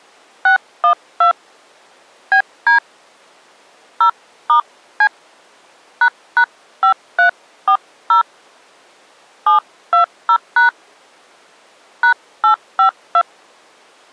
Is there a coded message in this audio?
Yes: DTMF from 0.5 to 13.2 s, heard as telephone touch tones, dialled by hand, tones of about 100 ms. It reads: 612 BD 0*C ##5340 720# #852